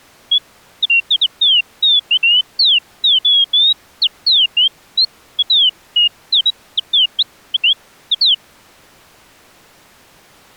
Bird-like chirps. There is no code.